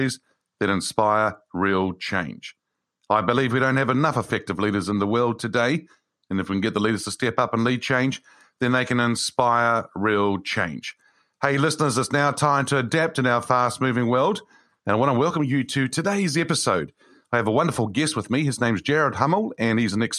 Speech in English. There is no code.